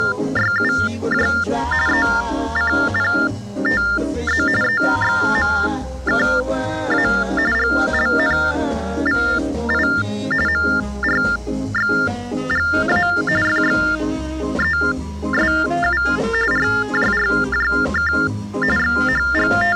TTY/TDD text telephone tones (45.45 baud Baudot), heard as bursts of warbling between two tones, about 400 Hz shift, 1600 Hz centre. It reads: … ECPTZ EXMKA GLNVI MRXGA FXESU RJRJK …